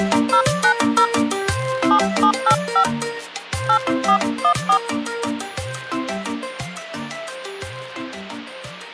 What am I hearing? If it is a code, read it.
DTMF, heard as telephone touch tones, dialled by hand, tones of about 80 ms, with hum. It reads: 090 7785 8414